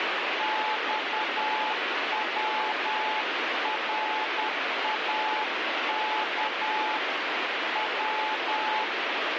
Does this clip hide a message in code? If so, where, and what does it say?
Yes: Morse code (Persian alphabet) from 0.3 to 8.9 s, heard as a keyed tone, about 10 wpm, 860 Hz, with heavy radio static. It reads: خوراک و